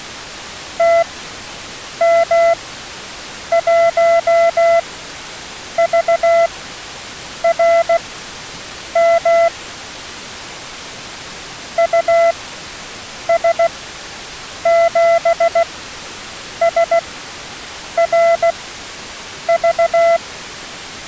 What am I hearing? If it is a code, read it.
Morse code, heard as a keyed tone, machine-sent, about 16 wpm, spaced as for 7 wpm, 670 Hz. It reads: TM1VRM US7SRV